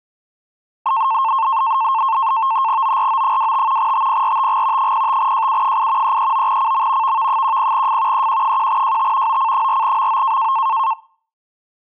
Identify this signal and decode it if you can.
NAVTEX (SITOR-B), 100 baud, 170 Hz shift, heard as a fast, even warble, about 980 Hz centre. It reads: ORO25 TPRTG 05JU8 339CM VV10F EQ1JT OC4MO